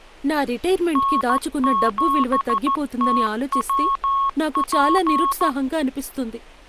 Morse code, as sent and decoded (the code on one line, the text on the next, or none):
-. --... - .-- .--.
N7TWP